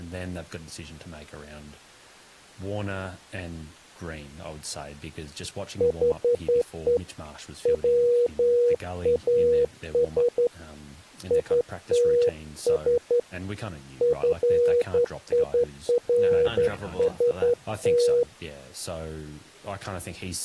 Morse code, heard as a keyed tone, hand-sent with a straight key, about 11 wpm, 480 Hz, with speech in English. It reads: HE WAS ITS FIRST